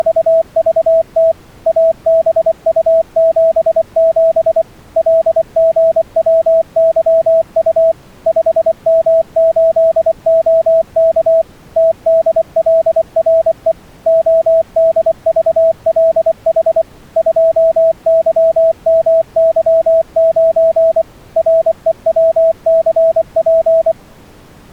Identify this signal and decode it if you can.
Morse code, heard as a keyed tone, machine-sent, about 24 wpm, 650 Hz. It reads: … ABU77 LGWYU 5M8OK TDLRE ODVLH 2YMY9 REWCP